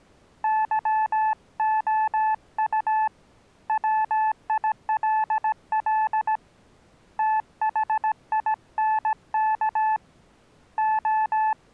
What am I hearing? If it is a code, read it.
Morse code, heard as a keyed tone, hand-sent with a paddle, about 17 wpm, 870 Hz. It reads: YOU WILL THINK …